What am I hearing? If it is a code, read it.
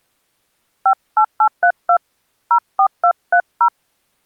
DTMF, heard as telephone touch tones, dialled by hand, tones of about 80 ms. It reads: 58832 04230